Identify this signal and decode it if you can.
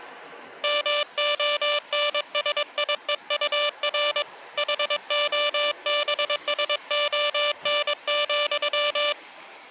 Morse code, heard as a buzzer, hand-sent with a paddle, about 22 wpm, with the noise of a park. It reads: MONSIEUR HOBSON,